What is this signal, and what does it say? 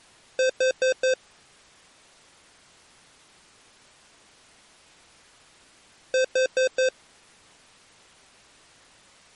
Alarm pattern, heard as an alarm's beeps, played twice, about 520 Hz. Temporal four. Carbon monoxide.